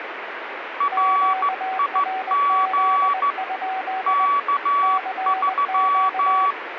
Morse code, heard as two keyed tones, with radio static. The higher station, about 14 wpm, 1140 Hz: RIG K3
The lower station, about 20 wpm, 760 Hz: QRZ? CQ